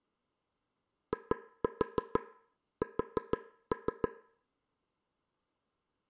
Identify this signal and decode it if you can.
Tap code, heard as taps on a table, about 6 knocks a second, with room echo. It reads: IS